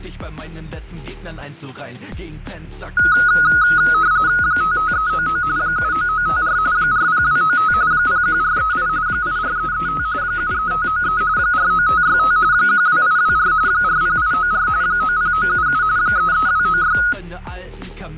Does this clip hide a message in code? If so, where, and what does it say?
Yes: RTTY (45.45 baud, 170 Hz shift) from 3.0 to 17.1 s, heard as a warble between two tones, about 1360 Hz centre, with fading. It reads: 55399 79954 40295 01438 84335 73593 49565 12824 40894 90977 33296